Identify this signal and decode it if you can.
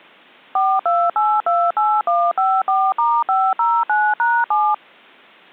DTMF, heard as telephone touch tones, dialled by machine, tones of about 240 ms. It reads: 42828154*509#7